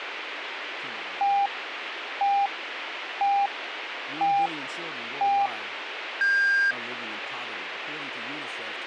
Radio time signal (five pips and a higher one, as on Chinese radio), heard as pips, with radio hiss and speech in English.